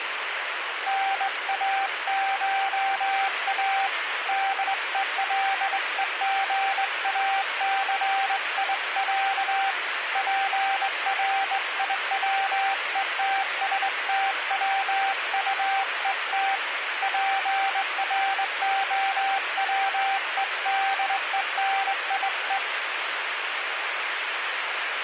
Morse code (Russian alphabet), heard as a keyed tone, hand-sent with a straight key, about 21 wpm, 780 Hz, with radio static. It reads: НАША ДЕЛЕГАЦИЯ ПРИВЕТСТВУЕТ ПРОВЕДЕНИЕ